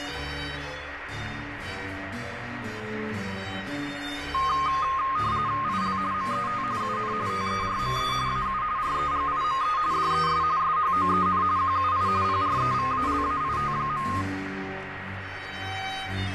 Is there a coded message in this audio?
Yes: RTTY (45.45 baud, 170 Hz shift) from 4.3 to 14.2 s, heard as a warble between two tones, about 1150 Hz centre, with radio static. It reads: IL MET UN TERME AU REGIME DES SHOEN QUI PREVALAIT.